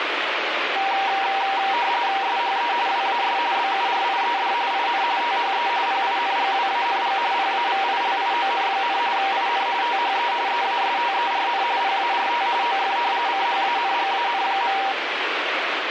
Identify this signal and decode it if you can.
RTTY (45.45 baud, 170 Hz shift), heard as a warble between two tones, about 870 Hz centre, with radio static. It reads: SHE WAS BURIED IN THE PINGWANG PAVILION, IN THE EASTERN PART OF CHANGAN.